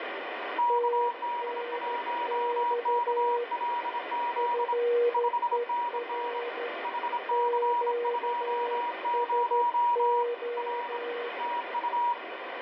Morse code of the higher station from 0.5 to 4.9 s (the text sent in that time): KD1KLZ